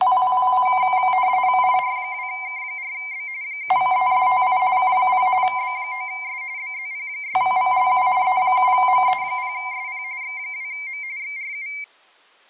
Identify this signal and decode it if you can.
RTTY (45.45 baud, 170 Hz shift), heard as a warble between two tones, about 2200 Hz centre. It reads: IR2K4B 7ESTI K0 B9S BZP6VLU E7ME0SP X2M XRU